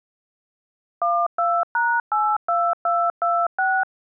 DTMF, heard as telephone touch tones, dialled by machine, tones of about 250 ms. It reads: 12#82226